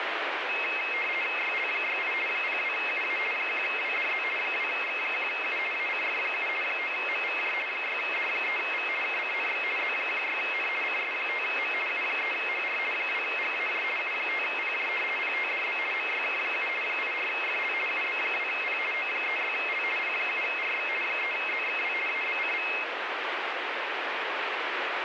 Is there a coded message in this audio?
Yes: RTTY (50 baud, 450 Hz shift) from 0.5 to 22.8 s, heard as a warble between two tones, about 2350 Hz centre, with radio static. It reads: YL68 02UA 1WDZ 2X1U ACF7 9MVJ 6D3V KCNX Z16N CS5M U3HR 2GAJ U5PJ PTDB MYK7 84FL UB2P O36L P7RX 3ZXW ABCV